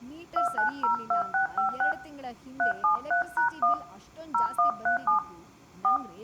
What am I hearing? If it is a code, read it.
DTMF, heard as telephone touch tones, dialled by hand, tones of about 120 ms, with room echo and speech in Kannada. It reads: 2902656 373#1 0137 4